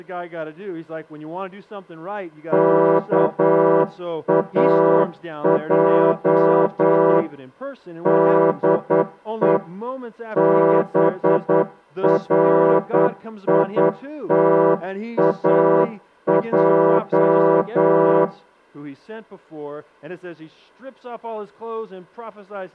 Morse code, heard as a horn, hand-sent with a straight key, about 9 wpm, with room echo. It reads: KAJ DE BRITAJ